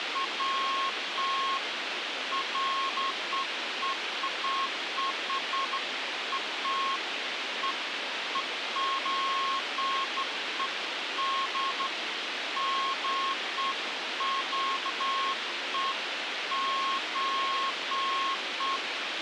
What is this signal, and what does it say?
Beeps of irregular length, with radio hiss and a squelch burst at the end. There is no code.